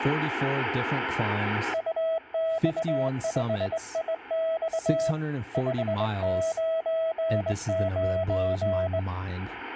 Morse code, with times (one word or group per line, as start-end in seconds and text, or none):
1.7-5.1 UX5IX
5.5-9.0 599